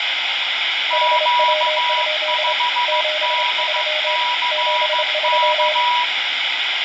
Morse code, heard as two keyed tones, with radio static. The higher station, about 15 wpm, 970 Hz: Q5DCK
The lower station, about 26 wpm, 610 Hz: HW? 73 73